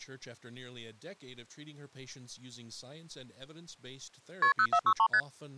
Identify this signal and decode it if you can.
Multi-frequency trunk signalling (R1, as on North American trunks), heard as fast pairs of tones, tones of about 70 ms, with speech in English. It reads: KP 0463 ST